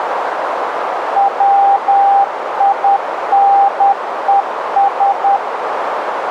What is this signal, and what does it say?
Morse code, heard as a keyed tone, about 10 wpm, 800 Hz, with radio static and a narrow filter. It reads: WINES